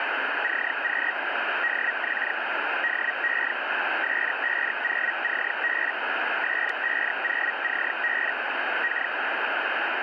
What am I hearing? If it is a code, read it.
Hellschreiber (Feld-Hell, 122.5 baud), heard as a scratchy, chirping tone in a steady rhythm, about 1900 Hz, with radio static. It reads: CQ DX DE S50CB S50CB K